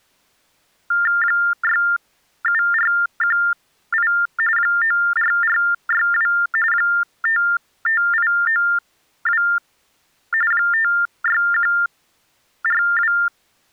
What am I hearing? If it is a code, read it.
TTY/TDD text telephone tones (45.45 baud Baudot), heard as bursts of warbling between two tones, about 400 Hz shift, 1600 Hz centre. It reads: 67418 94462 55892 56142